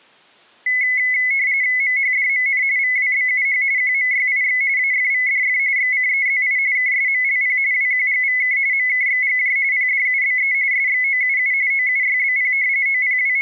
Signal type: RTTY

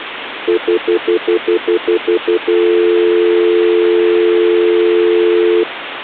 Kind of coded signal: telephone call progress tone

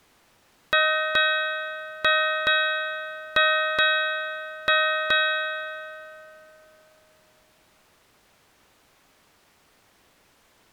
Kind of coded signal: ship's bell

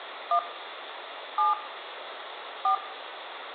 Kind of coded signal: DTMF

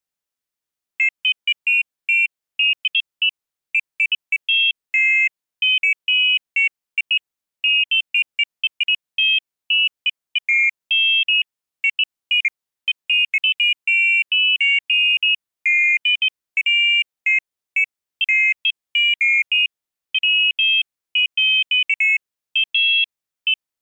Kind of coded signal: none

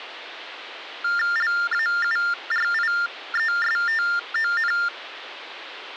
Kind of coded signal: TTY/TDD text telephone tones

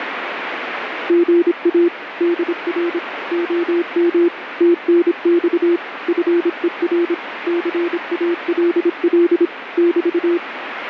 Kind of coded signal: Morse code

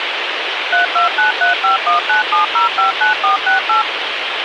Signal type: DTMF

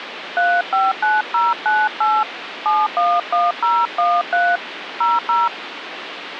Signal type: DTMF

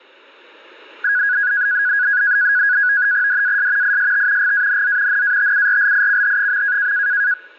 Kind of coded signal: NAVTEX (SITOR-B)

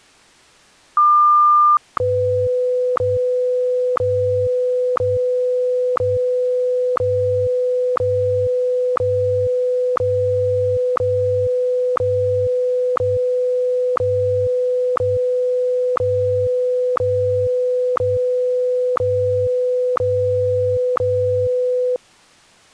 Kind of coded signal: radio time signal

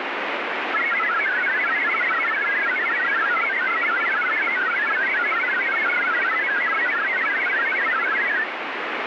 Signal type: multi-tone FSK (Olivia or MFSK type)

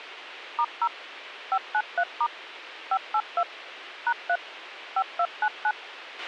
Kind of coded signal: DTMF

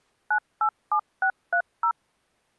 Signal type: DTMF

